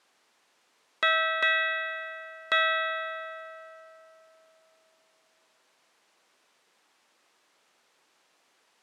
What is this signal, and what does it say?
Ship's bell, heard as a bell. 3. Three half-hours of the watch have passed.